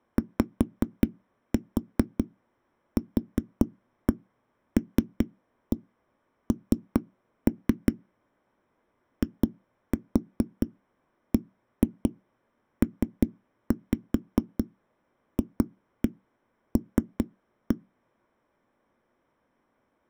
Tap code, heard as knocks on a wall, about 5 knocks a second. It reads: YQLN IBPFL